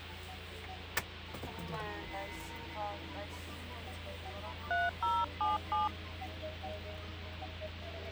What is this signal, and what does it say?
DTMF, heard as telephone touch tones, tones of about 160 ms, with the noise inside a car. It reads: 3077